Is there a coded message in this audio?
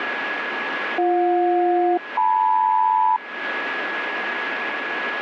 Yes: aircraft SELCAL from 1.0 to 3.2 s, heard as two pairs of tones, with radio static and a steady whistle near 1680 Hz. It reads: BJ-LM